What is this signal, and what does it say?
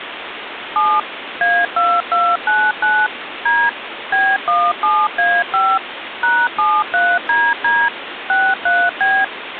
DTMF, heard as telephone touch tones, dialled by machine, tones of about 240 ms, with phone line noise. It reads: 7 A2299 D B17A5 #73DD 63B